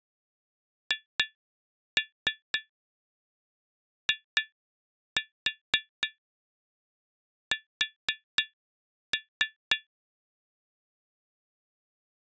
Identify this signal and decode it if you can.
Tap code, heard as taps on glass, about 4 knocks a second. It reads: HIS